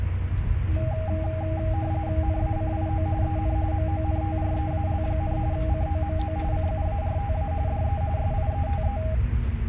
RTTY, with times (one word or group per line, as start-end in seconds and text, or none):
2.2-3.1 NACIO
3.2-3.6 EN
3.7-5.4 MONTREAL,
5.5-6.4 COMO
6.5-7.5 CUARTA
7.7-8.0 DE
8.2-9.0 SIETE